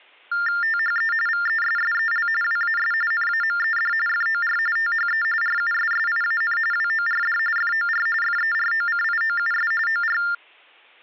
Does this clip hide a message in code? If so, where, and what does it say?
Yes: TTY/TDD text telephone tones (45.45 baud Baudot) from 0.3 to 10.3 s, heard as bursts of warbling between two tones, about 400 Hz shift, 1600 Hz centre. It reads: THE VESSEL WAS NAMED FOR THE RUSSIAN WORD FOR FEROCIOUS OR